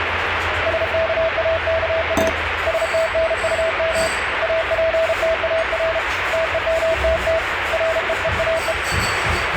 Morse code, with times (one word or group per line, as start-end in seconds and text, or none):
0.7-2.3 SKAKA
2.7-4.1 STNUM
4.4-6.0 APTAR
6.3-7.4 TEMTT
7.7-8.7 REEAE